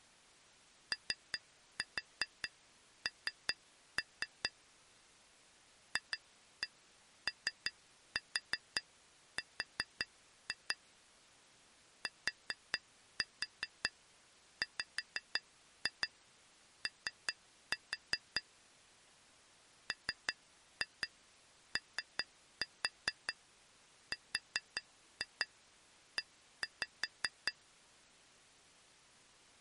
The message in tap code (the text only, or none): ON FOR TWO MORE